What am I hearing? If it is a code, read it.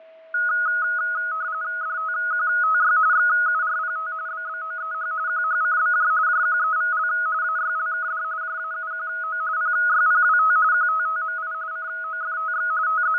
RTTY (45.45 baud, 170 Hz shift), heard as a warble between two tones, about 1360 Hz centre, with fading and a steady whistle near 650 Hz. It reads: DTQTY XURPT BBOEH QHCBJ JQEVL AYLKD JAUQO PYPWT QTTMI COFTX …